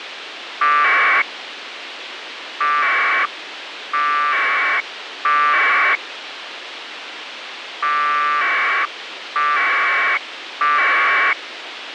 Packet radio (AX.25, as in APRS), 1200 baud, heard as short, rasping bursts, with radio hiss.